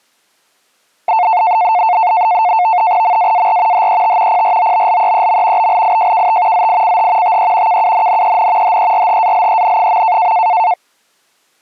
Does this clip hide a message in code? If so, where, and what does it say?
Yes: NAVTEX (SITOR-B), 100 baud, 170 Hz shift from 1.1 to 10.7 s, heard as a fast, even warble, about 800 Hz centre. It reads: MAAR HET PROBLEEM BLIJKT ZICH TE KUNNEN HERHALEN.